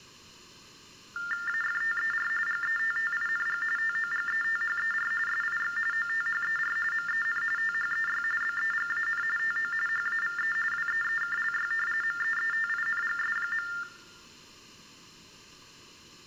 TTY/TDD text telephone tones (45.45 baud Baudot), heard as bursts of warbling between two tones, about 400 Hz shift, 1600 Hz centre, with room echo. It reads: AFTER GETTING TOGETHER SIX OTHER MEN THEY BEGAN TO HAVE WEEKLY MEETINGS.